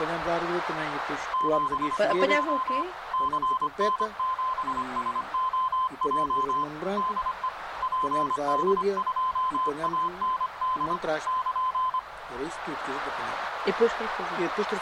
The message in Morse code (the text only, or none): 72 CN7SOJ DE PD2AND <KN>